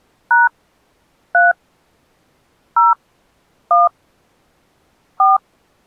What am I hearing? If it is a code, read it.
DTMF, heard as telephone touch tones, dialled by hand, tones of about 170 ms. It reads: # 3 0 1 4